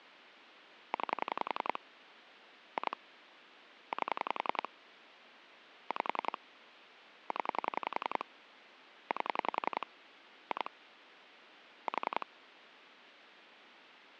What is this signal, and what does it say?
Pulse dialling, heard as clicks on a phone line, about 11 pulses a second, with phone line noise. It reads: 9 2 8 5 0 8 2 4